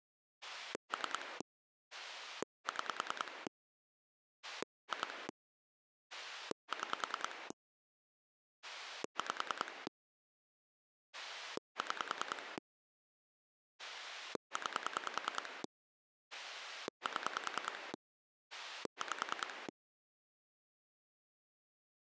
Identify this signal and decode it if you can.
Pulse dialling, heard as a rotary dial, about 10 pulses a second. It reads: 3 6 2 6 5 6 9 7 5